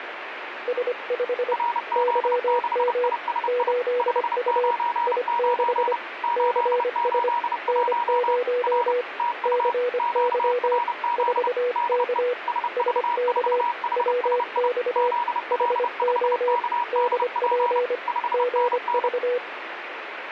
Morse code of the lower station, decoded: S5 YM 8U I6 CS N0 CY 4K SK WX HO DP GV

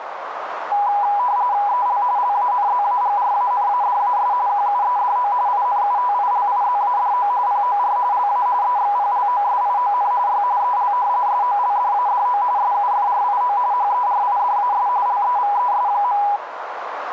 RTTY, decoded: EL LANZAGRANADAS QUEDO INUTILIZADO POR LA EXPLOSION Y EL SOLDADO SUFRIO HERIDAS LEVES.

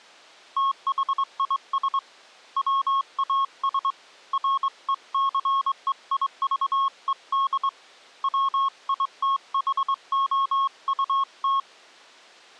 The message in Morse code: THIS WAS RECEIVED WITHOUT

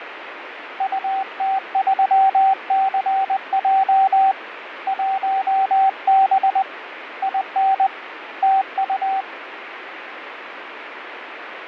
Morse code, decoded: UT3CJ 1B IN TU

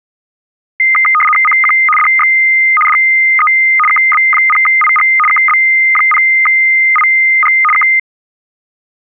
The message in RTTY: CQ DX DE KB0IG KB0IG K

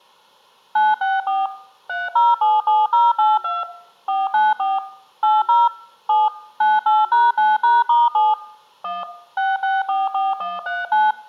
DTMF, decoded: 964 3077082 494 80 7 98#9#*7 1 6644139

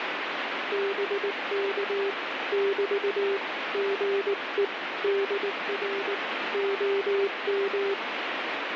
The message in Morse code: BK <BT> GE DR OM

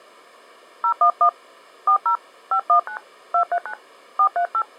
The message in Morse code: none

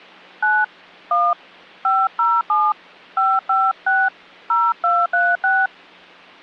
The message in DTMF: 9 1 507 556 0236

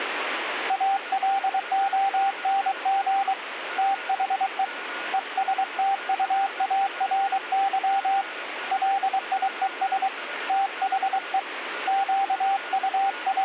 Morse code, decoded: ALONG THE ESTUARY LIES THE …

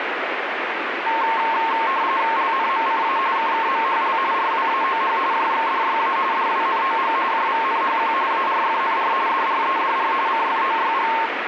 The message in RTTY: LNMCA KKMHL RWAOH JXDYA DWNOG JVNHQ ARFNR DREDR CFOYG

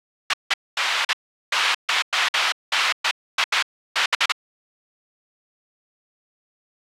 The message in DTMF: none

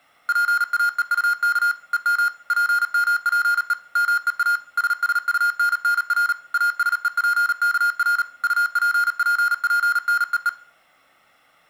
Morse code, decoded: PAEUK EM PMPE MEA SSUNNR ASEPKR UPPPNEE

